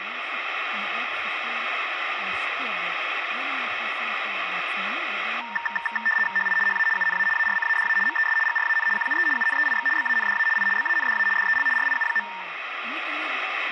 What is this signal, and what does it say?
RTTY (75 baud, 850 Hz shift), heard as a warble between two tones, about 1360 Hz centre, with radio static, a steady whistle near 2210 Hz and speech in Hebrew. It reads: HI HA UNA ARCADA MES GRAN QUE UNEIX BANDA I BANDA DEL RIU.